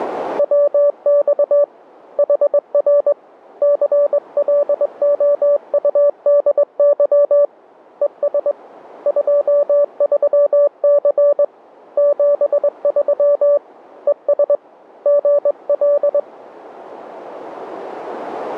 Morse code, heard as a keyed tone, hand-sent with a straight key, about 21 wpm, 580 Hz. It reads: WX HR CLOUDY ES 23C 73 ES GL